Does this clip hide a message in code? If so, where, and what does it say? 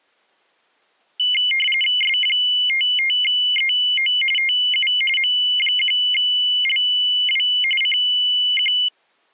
Yes: RTTY (45.45 baud, 850 Hz shift) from 1.2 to 8.9 s, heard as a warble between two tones, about 2550 Hz centre. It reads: S55EO TU M1LW CQ